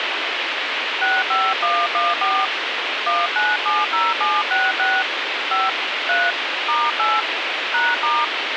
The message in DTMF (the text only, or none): 65114 1970766 5 3 *8 #*